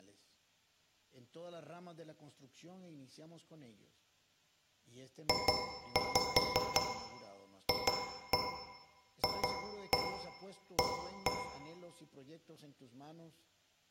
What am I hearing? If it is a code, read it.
Tap code, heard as taps on a metal pipe, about 5 knocks a second, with room echo and speech in Spanish. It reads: JFFA